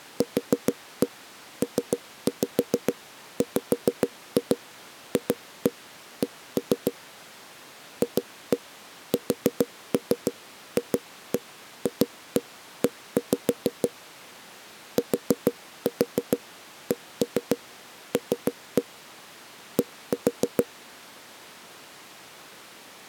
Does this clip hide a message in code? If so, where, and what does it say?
Yes: tap code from 0.2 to 20.7 s, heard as knocks on a wall, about 6 knocks a second. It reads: QPWFC FSFFE TCL D